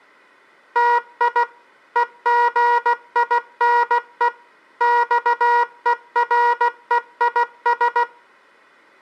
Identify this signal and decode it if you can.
Morse code (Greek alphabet), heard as a buzzer, machine-sent, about 16 wpm. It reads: ΤΙ ΕΓΙΝΕ ΞΕΡΕΙΣ